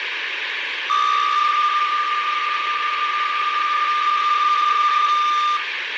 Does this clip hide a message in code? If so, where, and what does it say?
Yes: PSK63 (62.5 baud) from 0.9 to 5.6 s, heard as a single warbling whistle, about 1200 Hz, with radio static, fading and room echo.